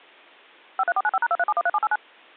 DTMF, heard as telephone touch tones, dialled by machine, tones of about 40 ms. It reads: 53495#23713789